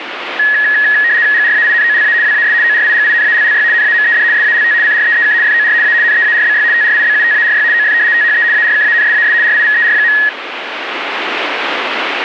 RTTY (75 baud, 170 Hz shift), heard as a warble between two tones, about 1800 Hz centre, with radio static. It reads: GRAINOLA WAS ORIGINALLY NAMED SALT CREEK FOR A NEARBY TRIBUTARY OF THE ARKANSAS RIVER.